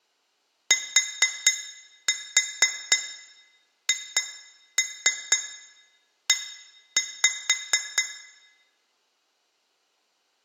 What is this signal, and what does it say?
Tap code, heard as taps on glass, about 4 knocks a second, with room echo. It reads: THE